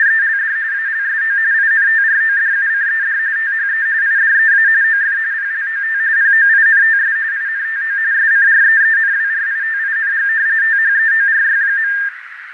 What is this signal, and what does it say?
RTTY (45.45 baud, 170 Hz shift), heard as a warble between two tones, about 1700 Hz centre, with radio static, fading and a narrow filter. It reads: … ALSO INTRODUCED THE IDEA OF PLOT POINTS INTO SCREENWRITING THEORY.